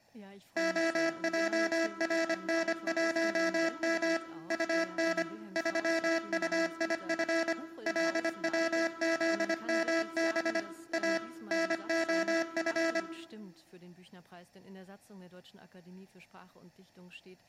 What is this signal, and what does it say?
Morse code, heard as a buzzer, machine-sent, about 25 wpm, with room echo. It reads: OJRN1M UN 3UIF LWZMB A NOF